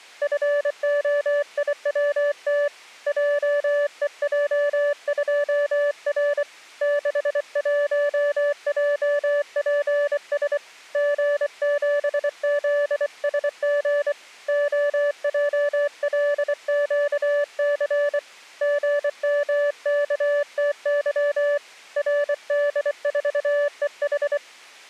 Morse code, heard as a keyed tone, hand-sent with a bug key, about 24 wpm, 580 Hz. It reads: FOIWT JEJ2R 61JPS G7ZSG OJLQC GMKTY RD4EH